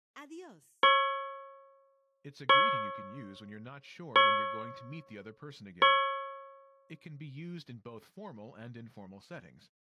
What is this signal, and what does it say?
Clock strike, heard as a bell, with speech in English. 4. Four o'clock.